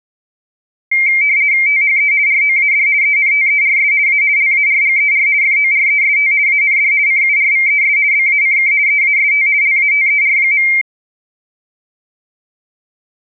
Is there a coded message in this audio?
Yes: RTTY (50 baud, 170 Hz shift) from 0.9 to 10.8 s, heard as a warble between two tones, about 2200 Hz centre. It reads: THE ROAD ENTERS A LARGER FOREST AND CURVES BACK EAST LATER.